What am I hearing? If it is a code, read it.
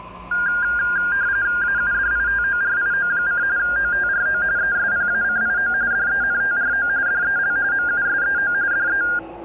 RTTY (45.45 baud, 170 Hz shift), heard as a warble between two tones, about 1500 Hz centre, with the noise of a subway station. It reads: AUDITORIO: OTRO ESPACIO DENTRO DEL MUSEO DE